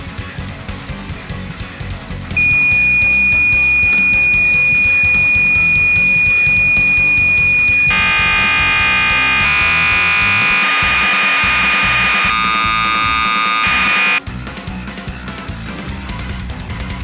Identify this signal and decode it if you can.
Cassette data (Kansas City type), 1200 baud, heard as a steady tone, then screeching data.